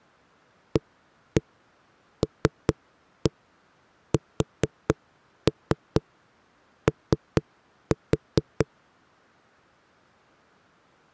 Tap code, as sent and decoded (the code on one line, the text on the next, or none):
1-1 3-1 4-3 3-4
ALSO